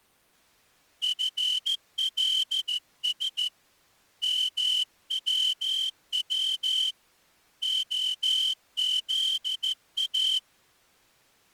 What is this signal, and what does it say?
Morse code, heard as a whistle, hand-sent with a straight key, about 14 wpm. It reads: FLS MWW OZA